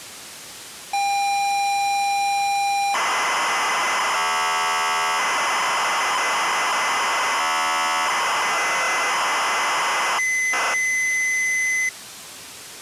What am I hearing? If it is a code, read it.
ZX Spectrum tape loading, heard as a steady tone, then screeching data.